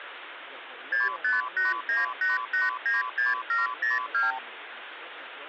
Multi-frequency trunk signalling (R2, with the far end's replies), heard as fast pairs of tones, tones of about 160 ms, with phone line noise. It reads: 65898896702